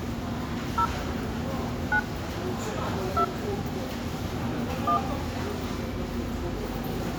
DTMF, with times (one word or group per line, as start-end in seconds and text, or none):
0.8-0.9 0
1.9-2.0 9
3.2-3.2 2
4.9-5.0 1